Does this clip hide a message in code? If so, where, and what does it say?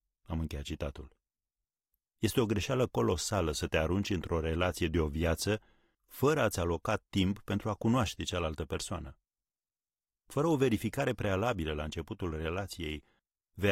No, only speech in Romanian.